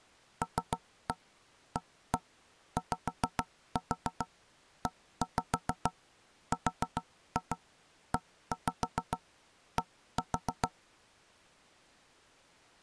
Tap code, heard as knocks on wood, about 7 knocks a second. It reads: LAYERED